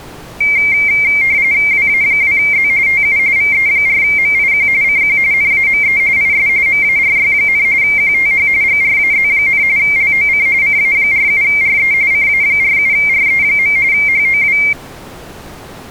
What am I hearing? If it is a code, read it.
RTTY (45.45 baud, 170 Hz shift), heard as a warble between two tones, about 2200 Hz centre. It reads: WA2Z TU VE4MIQ CQ NAME IS MARY, QTH GRAZ, LOC CA47RE CA47RE. HOW